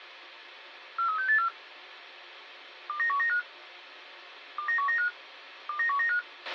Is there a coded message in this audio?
Yes: five-tone selective call (CCIR) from 1.0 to 6.2 s, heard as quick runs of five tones, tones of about 100 ms, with a squelch burst at the end. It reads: 43684 29195 29195 29195